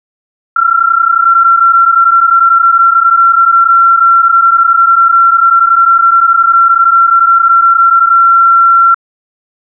PSK31 (31.25 baud), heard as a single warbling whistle, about 1360 Hz.